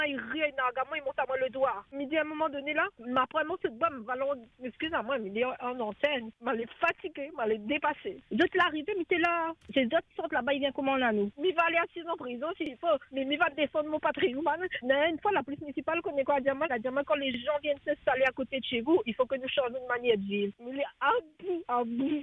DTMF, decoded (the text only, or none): none